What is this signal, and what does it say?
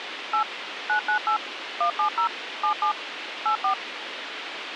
DTMF, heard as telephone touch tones, dialled by machine, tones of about 100 ms, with radio hiss. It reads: 8 998 170 77 84